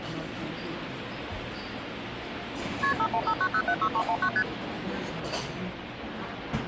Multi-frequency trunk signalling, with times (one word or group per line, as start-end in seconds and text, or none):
2.8-2.9 KP
3.0-4.3 5159076319
4.4-4.4 ST